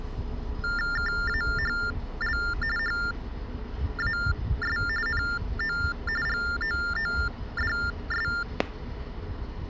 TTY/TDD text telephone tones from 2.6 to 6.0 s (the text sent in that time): HAS NO